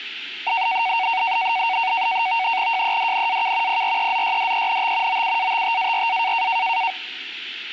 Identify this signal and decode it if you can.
NAVTEX (SITOR-B), 100 baud, 170 Hz shift, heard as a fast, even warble, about 840 Hz centre. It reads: JEDNAK PREZYDENT OUATTARA